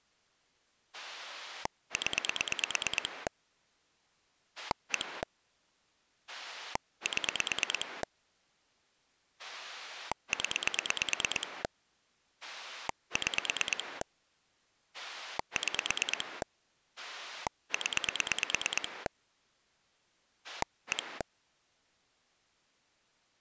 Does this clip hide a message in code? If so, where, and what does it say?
Yes: pulse dialling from 0.9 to 21.2 s, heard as a rotary dial, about 9 pulses a second. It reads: 0 1 7 0 6 6 0 1